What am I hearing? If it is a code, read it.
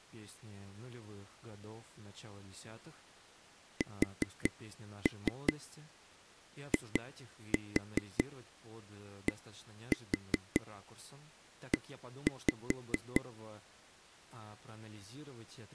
Tap code, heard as taps on a table, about 5 knocks a second, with speech in Russian. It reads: SIDE